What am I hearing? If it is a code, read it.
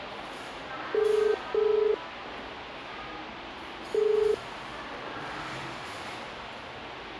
Telephone call progress tone (as in the UK, Ireland, Australia and similar networks), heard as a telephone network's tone, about 430 Hz, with the noise of a cafe. Ringback tone.